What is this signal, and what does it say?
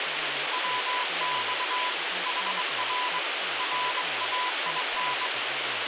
Morse code, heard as a keyed tone, hand-sent with a straight key, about 22 wpm, 1000 Hz, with radio static and speech in English. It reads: WX HR RAIN